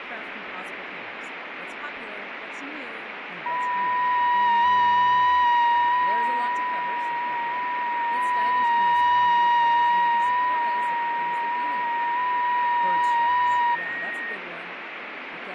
FT8 (several signals at once), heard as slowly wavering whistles, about 6.25 baud, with radio static and fading.